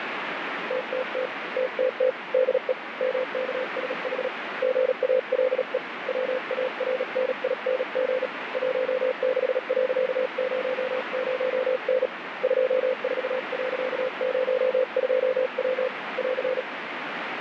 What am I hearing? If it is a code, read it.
Morse code, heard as a keyed tone, hand-sent with a paddle, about 37 wpm, 510 Hz, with radio static. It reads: TTT TTT DE MKSH GALE WARNING 16.00N 24.02W <AR>